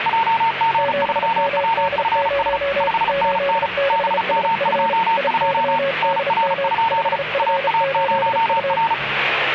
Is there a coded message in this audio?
Yes: Morse code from 0.0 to 9.0 s, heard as two keyed tones, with radio static and the noise of a cafe. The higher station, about 35 wpm, 910 Hz: JG3WFS 5NN BM22 NR? AA0R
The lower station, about 34 wpm, 550 Hz: 7MD0 86SF IYDM 5F8U